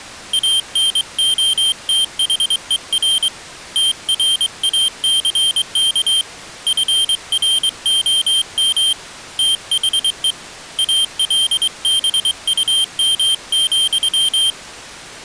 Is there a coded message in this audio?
Yes: Morse code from 0.3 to 14.6 s, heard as a high beeper, hand-sent with a straight key, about 23 wpm, 3150 Hz. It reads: ANOTHER TRACK FROM THE ALBUM,